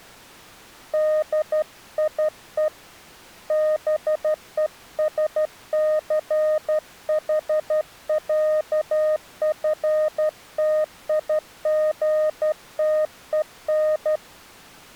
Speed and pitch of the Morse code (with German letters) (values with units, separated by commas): 12 wpm, 620 Hz